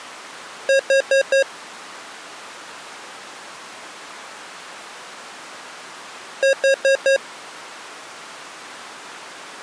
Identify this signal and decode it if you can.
Alarm pattern, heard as an alarm's beeps, played twice, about 540 Hz. Temporal four. Carbon monoxide.